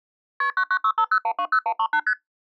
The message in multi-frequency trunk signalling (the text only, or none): KP 99650120138 ST